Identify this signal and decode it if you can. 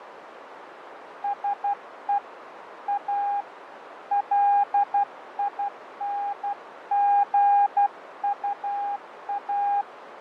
Morse code, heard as a keyed tone, hand-sent with a paddle, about 12 wpm, 810 Hz, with radio static, fading and a narrow filter. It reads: SE A LINGUA